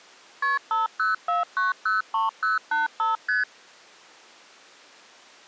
Multi-frequency trunk signalling (R1, as on North American trunks), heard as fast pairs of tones, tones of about 150 ms. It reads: KP 504903085 ST